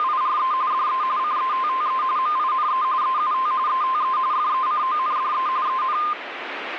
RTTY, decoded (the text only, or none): … DE CETTE MINE EUT ETE FECONDE EN